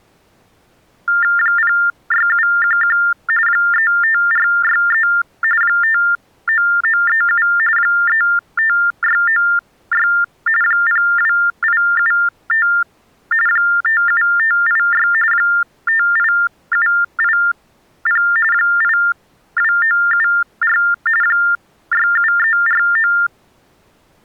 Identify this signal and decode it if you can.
TTY/TDD text telephone tones (45.45 baud Baudot), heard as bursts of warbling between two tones, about 400 Hz shift, 1600 Hz centre. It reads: 06711 35463 59937 35696 02875 57586 58780 82974 67349